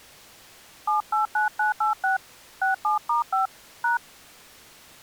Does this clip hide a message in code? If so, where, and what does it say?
Yes: DTMF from 0.9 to 4.0 s, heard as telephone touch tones, dialled by hand, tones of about 130 ms. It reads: 789986 67*5 #